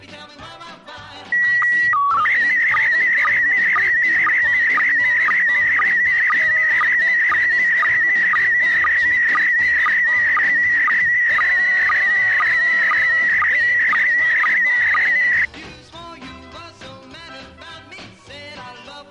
SSTV (slow-scan television), PD 120, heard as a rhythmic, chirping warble.